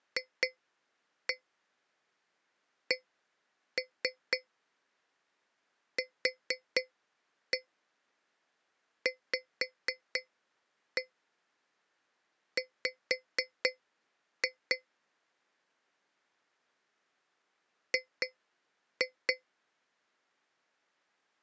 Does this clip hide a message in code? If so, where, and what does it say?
Yes: tap code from 0.2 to 19.4 s, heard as taps on a metal pipe, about 4 knocks a second. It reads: FCQVW G